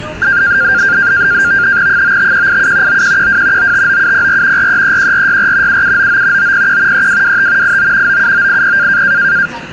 NAVTEX (SITOR-B), 100 baud, 170 Hz shift, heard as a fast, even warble, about 1500 Hz centre, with radio static and the noise inside a subway train. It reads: 95187 9112 959704 4331464 7799 901 3225 89 97980